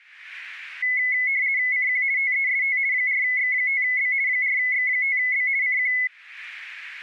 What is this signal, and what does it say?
RTTY (50 baud, 170 Hz shift), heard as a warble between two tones, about 2100 Hz centre. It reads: CQ TEST 4X5B 4X5B CQ